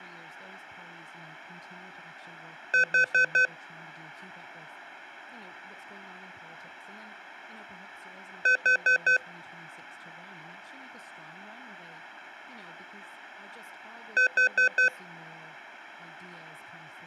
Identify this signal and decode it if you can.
Alarm pattern, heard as an alarm's beeps, played three times, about 510 Hz, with room echo and speech in English. Temporal four. Carbon monoxide.